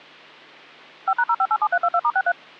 DTMF, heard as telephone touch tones, dialled by machine, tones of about 60 ms. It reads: 5#0587322*63